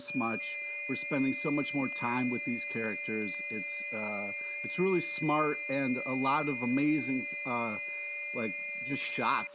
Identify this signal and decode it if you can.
FT8 (several signals at once), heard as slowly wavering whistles, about 6.25 baud, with static crashes, a steady whistle near 580 Hz and speech in English.